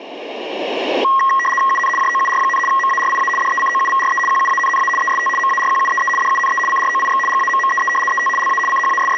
RTTY (75 baud, 850 Hz shift), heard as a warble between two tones, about 1500 Hz centre. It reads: UN JOUR, MARIA DECOUVRE QUANNA EST MARQUEE DUNE CROIX GAMMEE ET LA …